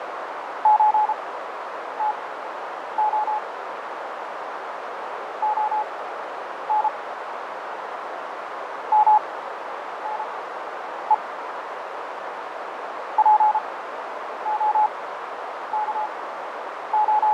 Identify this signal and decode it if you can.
Morse code (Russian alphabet), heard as a keyed tone, machine-sent, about 33 wpm, spaced as for 9 wpm, 850 Hz, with heavy radio static, fading and a narrow filter. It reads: ЧТО ОН МНЕ …